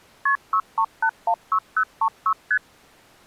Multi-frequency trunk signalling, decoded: KP 63816036 ST

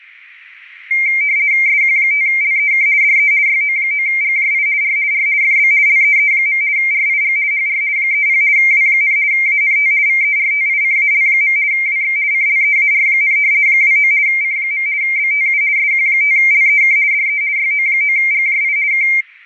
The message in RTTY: SQ5LEK DE YO9GJI R R FB LEE. RIG HR 30 W, ANT VERTICAL. WX CLEAR, 29 C. BTU SQ5LEK DE YO9GJI K

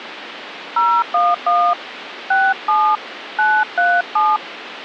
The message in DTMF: 011 67 937

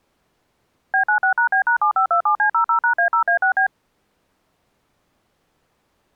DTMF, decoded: B96#B#7527C00#A0A6B

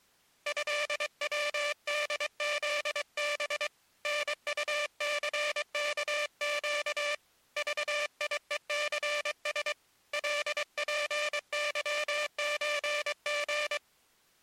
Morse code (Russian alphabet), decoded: ЭВДЗБ НУЦКЩ ЖИЕЦС ЛПЫЧГ

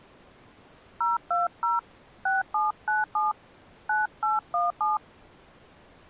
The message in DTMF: 020 6797 9817

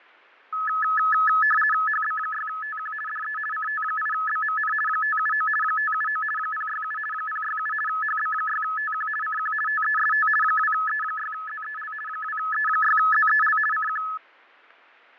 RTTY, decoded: HB6TQ DE CT8BMN 579 579 067 067 HB6TQ CQ TEST 2E6ZEL 2E6ZEL CQ

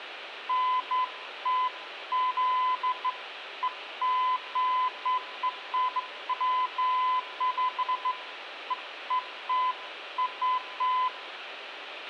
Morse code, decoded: none

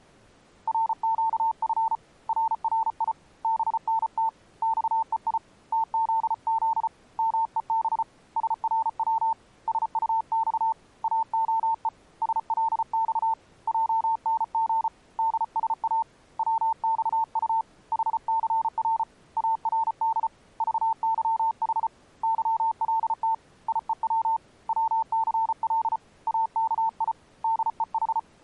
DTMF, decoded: none

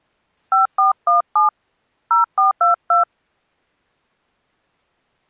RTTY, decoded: none

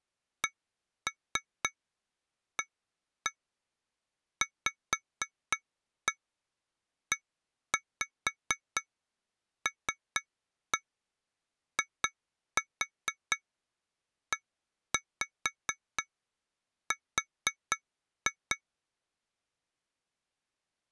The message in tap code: CAVELIER

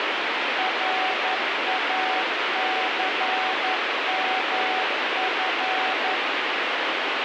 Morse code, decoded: RACMF

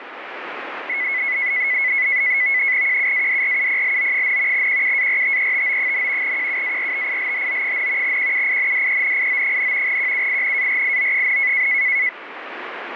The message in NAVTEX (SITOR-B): QUADRUPLO, QUARTETO, QUARTILHO, QUINDENIO, QUINARIO,

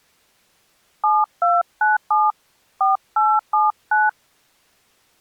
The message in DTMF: 7297 4879

